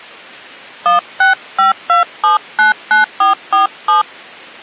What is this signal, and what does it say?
DTMF, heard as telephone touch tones, dialled by hand, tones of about 140 ms. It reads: 1652799447